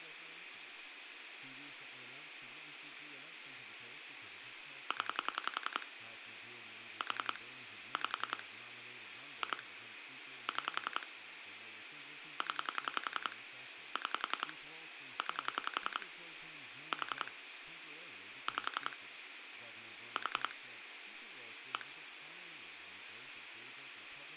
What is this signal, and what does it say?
Pulse dialling, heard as clicks on a phone line, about 10 pulses a second, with phone line noise and speech in English. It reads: 0 4 5 2 6 0 6 9 4 5 4 1